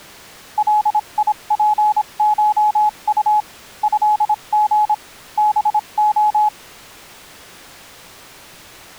Morse code (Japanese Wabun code), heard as a keyed tone, machine-sent, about 26 wpm, spaced as for 23 wpm, 850 Hz. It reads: ガツコウ トリ ハレ